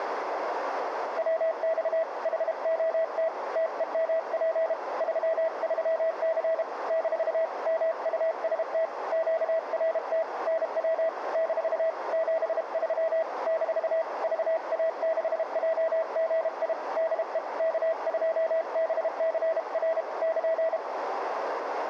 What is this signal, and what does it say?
Morse code, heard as a keyed tone, hand-sent with a paddle, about 32 wpm, 650 Hz, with radio static and a narrow filter. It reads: WX HOT TEMP 33C - MUST QRT NW - 73 - VA6JGI DE K2BCR <KN>